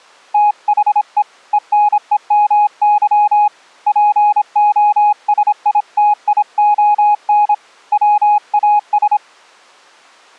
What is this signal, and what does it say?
Morse code, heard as a keyed tone, hand-sent with a paddle, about 26 wpm, 830 Hz. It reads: THE ENEMY POSITION WAS